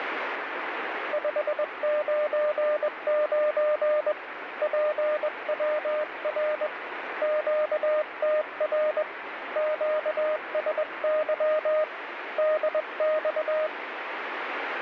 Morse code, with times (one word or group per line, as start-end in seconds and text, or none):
1.1-4.1 599
4.6-6.7 PWR
7.2-9.0 QTR
9.6-11.8 QSY
12.4-13.7 DX